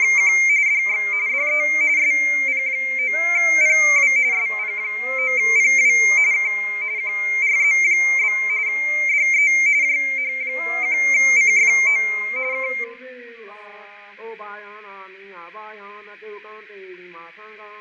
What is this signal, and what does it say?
RTTY (45.45 baud, 170 Hz shift), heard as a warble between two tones, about 2200 Hz centre, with radio static and fading. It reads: … DX DE SP9PW SP9PW K QRZ? DE JH1CFO K